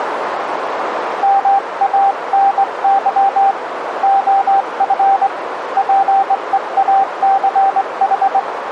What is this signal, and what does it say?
Morse code, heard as a keyed tone, hand-sent with a straight key, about 21 wpm, 780 Hz, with radio static and a narrow filter. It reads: MANY OF PEACH